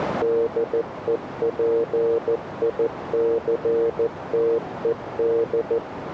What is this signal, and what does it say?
Morse code, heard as a keyed tone, machine-sent, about 14 wpm, 460 Hz, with radio static and a narrow filter. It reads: DEPICTED